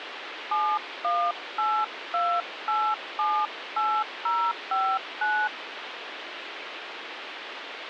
DTMF, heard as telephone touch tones, dialled by hand, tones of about 260 ms, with phone line noise. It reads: 7182878059